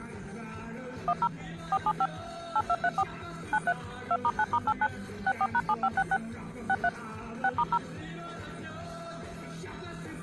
DTMF, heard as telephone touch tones, dialled by machine, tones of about 50 ms. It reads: 10 475 8234 93 2*9*89 64#7566 63 6*0